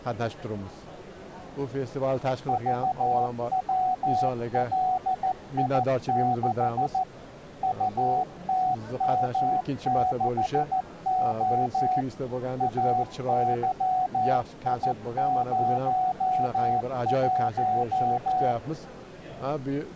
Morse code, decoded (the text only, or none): VWLI6 UTM6O AYI01